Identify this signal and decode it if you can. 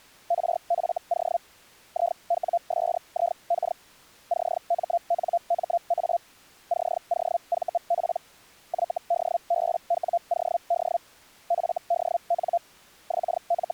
Hellschreiber (Feld-Hell, 122.5 baud), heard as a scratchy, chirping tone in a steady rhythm, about 690 Hz. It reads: RFO IWSIK CMNMA COVP YDBWOD FDN …